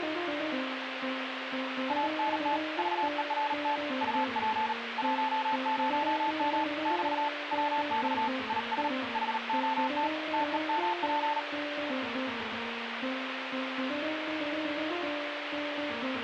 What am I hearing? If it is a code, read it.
Morse code, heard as a keyed tone, hand-sent with a paddle, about 38 wpm, 880 Hz, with radio static. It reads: ANT VERT UP 10M <BT> WX IS HOT TEMP